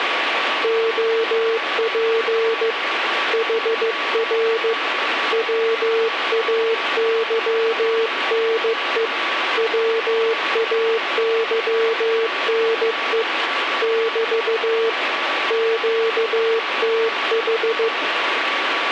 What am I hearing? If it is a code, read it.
Morse code, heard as a keyed tone, hand-sent with a paddle, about 15 wpm, 450 Hz, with radio static and a steady whistle near 1140 Hz. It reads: OP HR WAYNE WAYNE <BT> QTH